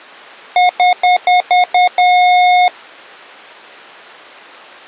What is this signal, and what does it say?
Beep code, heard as beeps from a small speaker, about 720 Hz. 6 short, 1 long.